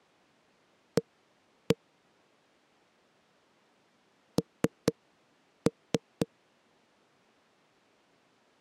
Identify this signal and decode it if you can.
Tap code, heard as knocks on a wall, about 4 knocks a second. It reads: A N